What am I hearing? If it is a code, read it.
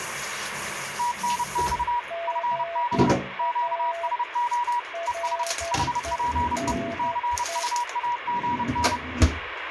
Morse code, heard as two keyed tones, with radio static and kitchen noise. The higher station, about 30 wpm, 960 Hz: TNX FB QSO ES HPE CUAGN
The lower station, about 11 wpm, 680 Hz: GA RENE